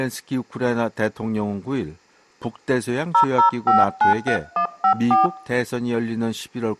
DTMF, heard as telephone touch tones, dialled by hand, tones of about 130 ms. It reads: 00593154